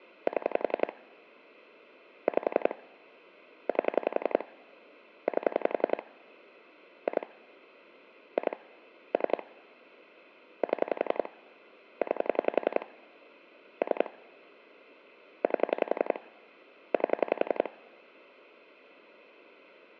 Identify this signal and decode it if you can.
Pulse dialling, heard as clicks on a phone line, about 11 pulses a second. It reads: 7 5 8 8 2 2 3 7 9 3 8 8